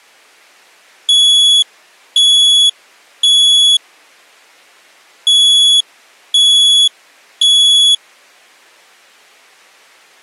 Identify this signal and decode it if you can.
Alarm pattern, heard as an alarm's beeps, played twice, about 3400 Hz. Temporal three. Smoke or fire, evacuate.